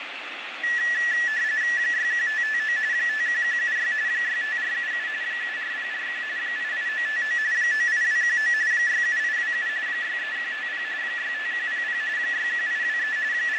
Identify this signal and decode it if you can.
RTTY (45.45 baud, 170 Hz shift), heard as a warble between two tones, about 1850 Hz centre, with radio static and fading. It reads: 61559 51176 65477 74041 88959 98219 67827 63150 65100 61823 …